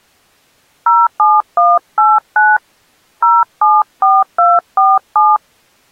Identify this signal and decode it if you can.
DTMF, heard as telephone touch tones, dialled by hand, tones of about 210 ms. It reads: 07189 074247